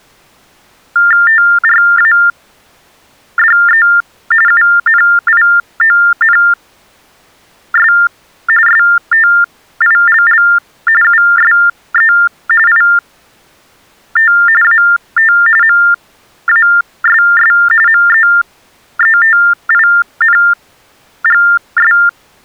TTY/TDD text telephone tones (45.45 baud Baudot), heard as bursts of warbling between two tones, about 400 Hz shift, 1600 Hz centre. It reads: TRADE UNIONS STILL USE IT AT MASS MEETINGS